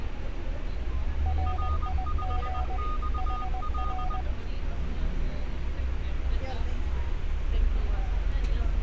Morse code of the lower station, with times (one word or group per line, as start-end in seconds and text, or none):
1.3-2.8 RIG
3.2-4.2 HR